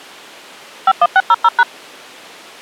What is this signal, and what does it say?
DTMF, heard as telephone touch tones, dialled by machine, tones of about 50 ms. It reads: 51600#